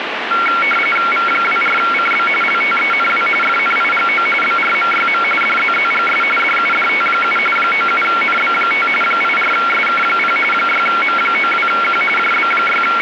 RTTY (45.45 baud, 850 Hz shift), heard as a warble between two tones, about 1800 Hz centre, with radio static. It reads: V24CB LTENW FNIGO BRMYM DZZGS DUDT7 97NB5 84SK0 6M92Q …